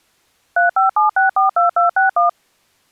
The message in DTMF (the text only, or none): 357642261